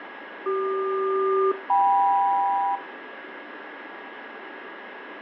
Aircraft SELCAL, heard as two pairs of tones, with radio static and a steady whistle near 1650 Hz. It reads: CQ-KM